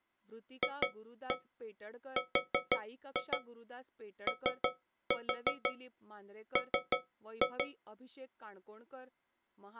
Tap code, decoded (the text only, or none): FROM